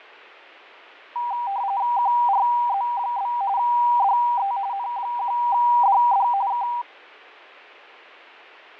RTTY (45.45 baud, 170 Hz shift), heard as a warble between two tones, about 880 Hz centre, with fading. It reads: QRZ? DE N1DD K